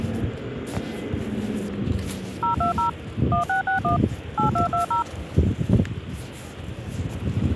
DTMF, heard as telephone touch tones, dialled by machine, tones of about 120 ms, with the noise of a residential street. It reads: 020 1661 8220